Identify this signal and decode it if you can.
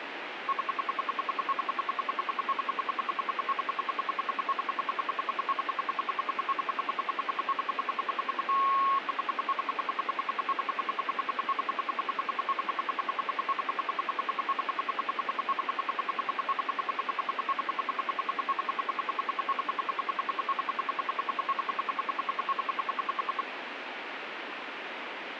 Radio time signal (RWM, Moscow), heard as ten pulses a second, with radio static.